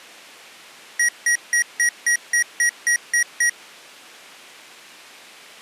Beep code, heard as beeps from a small speaker, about 1900 Hz. 10 short. In AMI BIOS tables: CMOS shutdown register error.